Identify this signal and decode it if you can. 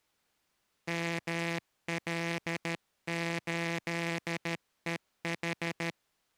Morse code, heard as a buzzer, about 13 wpm. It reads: ML8EH